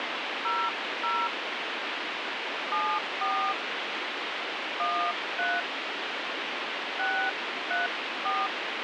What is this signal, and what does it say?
DTMF, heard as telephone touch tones, dialled by hand, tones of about 240 ms, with radio hiss. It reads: 00 74 13 634